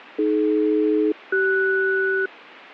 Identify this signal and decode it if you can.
Aircraft SELCAL, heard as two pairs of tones, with radio static. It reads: AD-CS